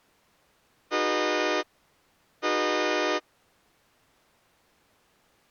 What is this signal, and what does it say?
Train horn signal, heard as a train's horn. 2 short. On North American railways: a signal is acknowledged.